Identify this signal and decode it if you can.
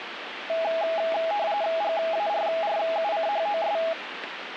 RTTY (45.45 baud, 170 Hz shift), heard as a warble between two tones, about 740 Hz centre, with radio static. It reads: GARRUCHOS